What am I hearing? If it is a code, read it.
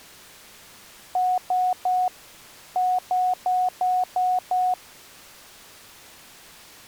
Beep code, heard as beeps, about 730 Hz. 3-6.